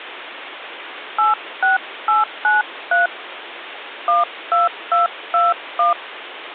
DTMF, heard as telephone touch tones, dialled by hand, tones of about 160 ms, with phone line noise. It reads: 86893 12221